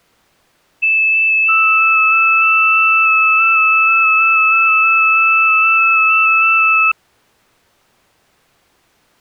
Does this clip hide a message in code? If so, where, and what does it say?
Yes: FT8 (several signals at once) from 0.8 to 6.9 s, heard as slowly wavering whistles, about 6.25 baud.